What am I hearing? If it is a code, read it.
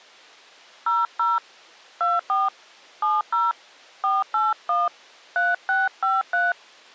DTMF, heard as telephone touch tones, dialled by hand, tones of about 190 ms. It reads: 00 24 70 481 3653